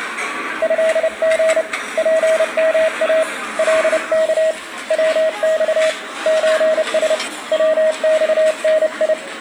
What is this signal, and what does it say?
Morse code (Japanese Wabun code), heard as a keyed tone, hand-sent with a paddle, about 30 wpm, 640 Hz, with the noise of a restaurant. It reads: トリ ツヨイ カワ ヤマ ソラ ヤマダ